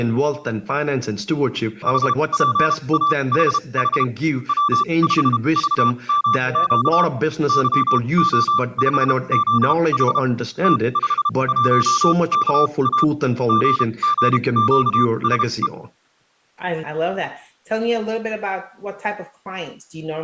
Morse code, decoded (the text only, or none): HPAHH W5VMQ YO5ZH T51KA GGQSE